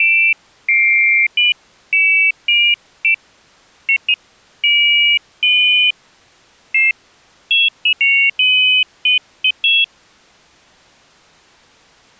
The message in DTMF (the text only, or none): none